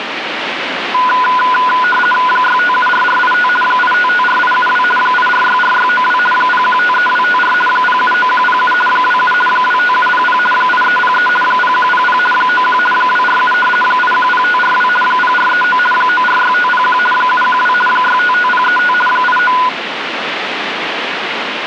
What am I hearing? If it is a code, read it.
RTTY (50 baud, 450 Hz shift), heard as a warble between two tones, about 1230 Hz centre, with radio static. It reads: 6574485 8554872 8464692 0153254 079107 27 25700 8303 0100 91 247 810542 0439 946501 712 655035 89